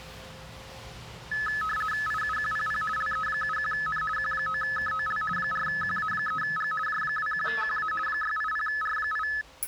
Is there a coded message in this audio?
Yes: RTTY (50 baud, 450 Hz shift) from 1.3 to 9.4 s, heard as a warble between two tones, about 1500 Hz centre, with the noise inside a lift. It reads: IUQPP LE71N Q9KOL 4QA3G J21QA 680R8